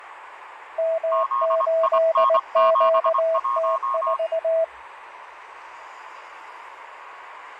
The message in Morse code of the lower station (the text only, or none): M8QT4